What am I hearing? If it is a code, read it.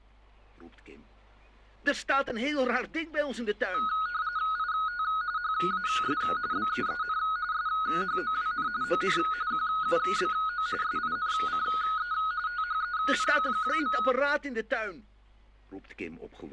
RTTY (45.45 baud, 170 Hz shift), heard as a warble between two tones, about 1360 Hz centre. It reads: IT HAS BEEN SHOWN ON QUBO SINCE THEN.